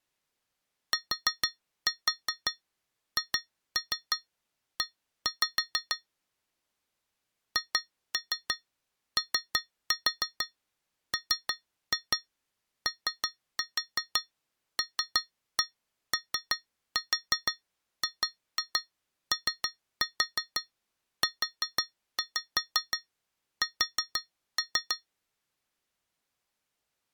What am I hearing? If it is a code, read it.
Tap code, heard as taps on glass, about 6 knocks a second. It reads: THE HOMOLOGOUS